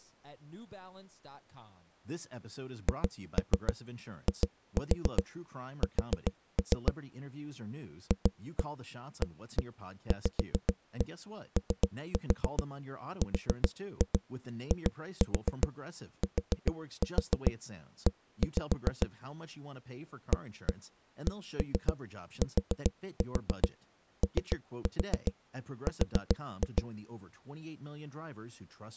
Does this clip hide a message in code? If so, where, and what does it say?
Yes: tap code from 2.9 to 26.9 s, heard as knocks on a wall, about 7 knocks a second, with speech in English. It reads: HIS FAVORITE ACTOR